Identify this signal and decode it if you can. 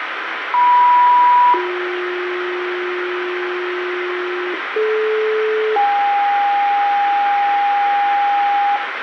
Two-tone page, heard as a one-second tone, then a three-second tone, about 980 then 360 Hz, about 430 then 810 Hz, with radio hiss and room echo.